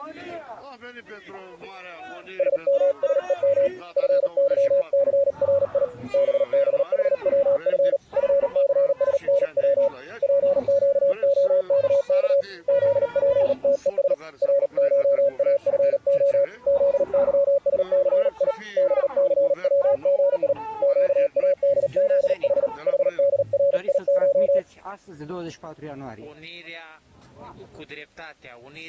Morse code (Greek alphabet), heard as a keyed tone, hand-sent with a paddle, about 38 wpm, 560 Hz. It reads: ΣΜΣΕΜ ΦΥΘΡΙ ΒΒΗΩΦ ΦΘΣΝΩ ΠΨΟΚΚ ΖΠΤΕΣ ΡΧΑΦΟ ΖΥΣΘΙ ΒΘΩΓΙ ΨΑΔΖΗ ΗΔΡΙΧ